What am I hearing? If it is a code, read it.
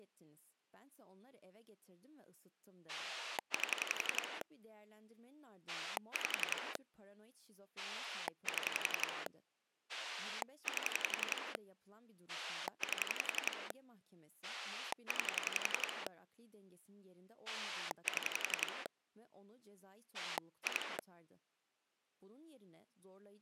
Pulse dialling, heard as a rotary dial, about 11 pulses a second, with speech in Turkish. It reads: 8 5 7 8 8 9 7 2